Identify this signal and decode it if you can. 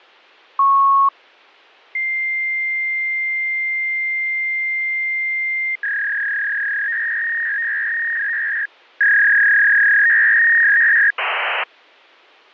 Fax machine handshake, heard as a beep, a long tone, a warble and hiss.